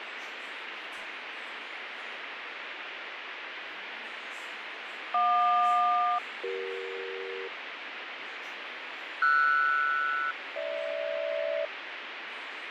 Aircraft SELCAL, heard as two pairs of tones, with radio static and fading. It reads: JQ-CE RS-GH